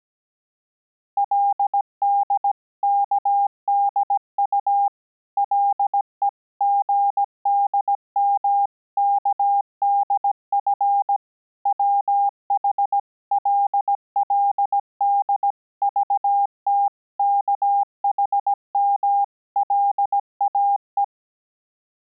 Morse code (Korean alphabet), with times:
1.2-4.9 그의
5.4-11.2 가슴은
11.7-21.0 부끄러움과

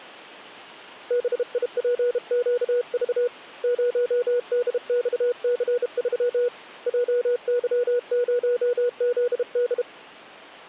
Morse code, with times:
1.1-3.3 BIPQV
3.6-6.5 0DXC3
6.9-9.8 JY0ZD

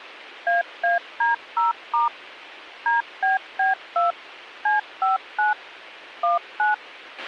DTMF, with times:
0.5-2.1 AAD0*
2.9-4.1 DBB2
4.7-5.5 C59
6.2-6.7 19

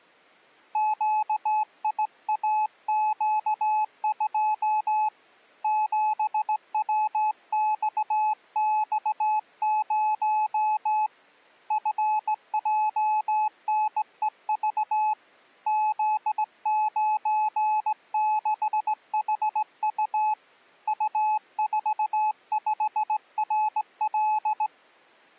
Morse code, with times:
0.8-5.1 QIAQ2
5.6-11.1 7WXX0
11.7-15.1 FJNEV
15.7-20.3 Z96HU
20.9-24.7 U45RL

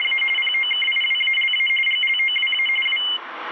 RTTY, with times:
0.0-0.2 …
0.4-1.7 POKIWALA
1.9-2.7 GLOWA
2.9-3.0 W

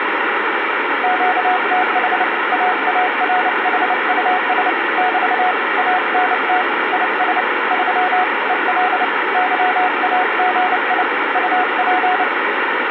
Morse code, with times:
1.0-2.2 QTH
2.5-4.7 AARHUS
5.0-5.5 <BT>
5.8-6.6 ANT
6.9-7.4 IS
7.7-8.2 3
8.5-9.0 EL
9.3-11.0 YAGI
11.4-12.2 UP

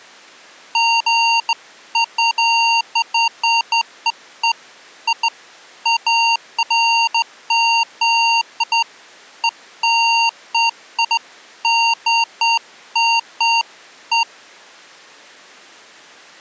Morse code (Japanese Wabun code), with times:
none

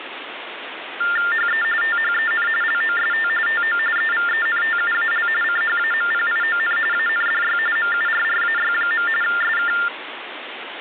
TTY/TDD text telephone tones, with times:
1.3-1.6 HE
1.8-2.5 THEN
2.6-3.3 LOST
3.5-3.8 TO
4.0-5.3 EVENTUAL
5.4-6.8 CHAMPION
6.9-7.6 ANDY
7.8-9.1 MURRAY.
9.2-9.7 SK

